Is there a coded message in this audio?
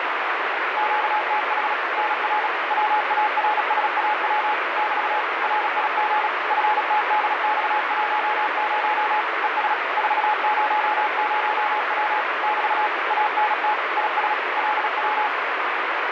Yes: Morse code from 0.7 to 15.3 s, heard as a keyed tone, machine-sent, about 36 wpm, 850 Hz, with heavy radio static. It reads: QTH NR WARSAW <BT> RIG FTDX10 ES 400W <BT> ANT IS LW